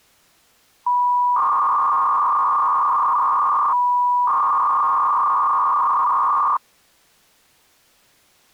300-baud modem data (V.21 tones), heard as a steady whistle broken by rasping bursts, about 300 baud, 200 Hz shift.